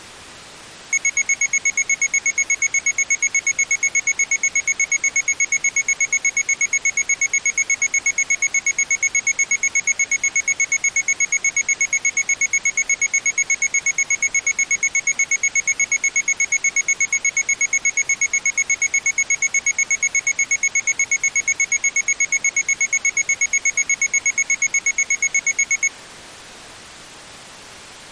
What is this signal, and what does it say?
Evenly repeated beeps. There is no code.